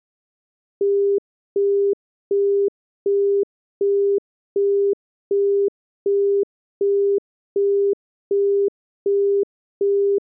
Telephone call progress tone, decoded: busy tone

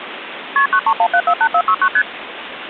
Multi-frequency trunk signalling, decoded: KP 931748469 ST

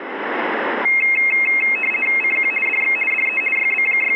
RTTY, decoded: CQ DX DE …

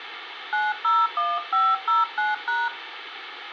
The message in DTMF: 901509#

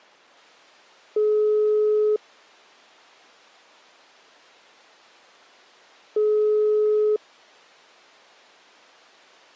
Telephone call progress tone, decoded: ringback tone

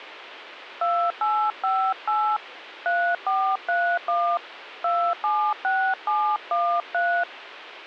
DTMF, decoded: 2858 3431 276713

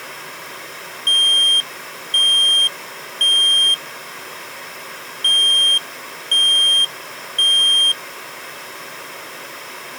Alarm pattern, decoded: temporal three

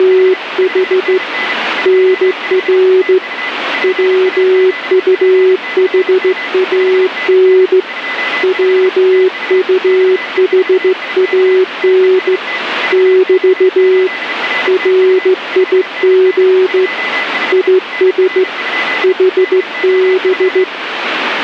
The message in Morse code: … NR WUHAN WUHAN <BT> RIG IS HB

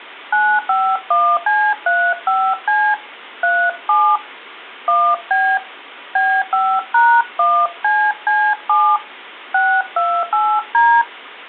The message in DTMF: 951C35C 37 1B B5#1CC7 628D

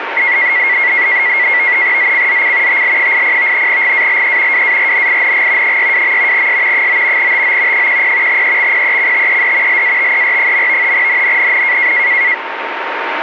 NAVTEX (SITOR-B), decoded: ZCZC TL80 GALE WARNING 62. S 9 TO 10 EXPECTED LATER. NNNN

